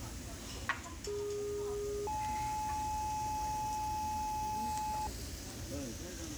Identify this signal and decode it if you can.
Two-tone page, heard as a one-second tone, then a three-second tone, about 410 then 860 Hz, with the noise of a crowd indoors.